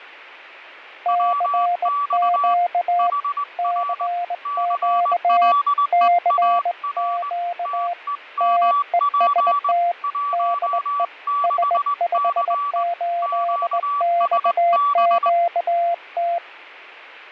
Morse code, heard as two keyed tones, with fading. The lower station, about 19 wpm, 700 Hz: CQ CQ CQ TEST DE S58XQT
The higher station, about 20 wpm, 1150 Hz: WX HR CLEAR TEMP 16C QSB